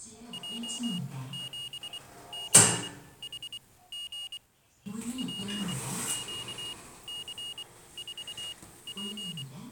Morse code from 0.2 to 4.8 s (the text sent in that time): J7CHG